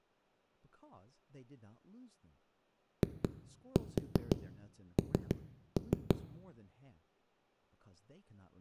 Tap code, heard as knocks on a wall, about 5 knocks a second, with room echo and speech in English. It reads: IN